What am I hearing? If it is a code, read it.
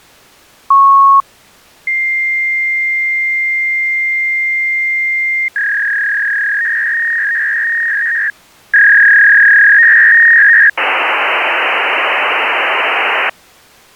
Fax machine handshake, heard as a beep, a long tone, a warble and hiss.